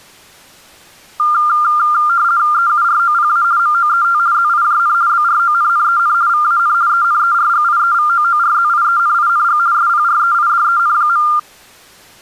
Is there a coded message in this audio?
Yes: RTTY (50 baud, 170 Hz shift) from 1.2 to 11.4 s, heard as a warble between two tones, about 1300 Hz centre. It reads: EUROPA MOET ZIJN BRONNEN VAN ENERGIEVOORZIENING SPREIDEN.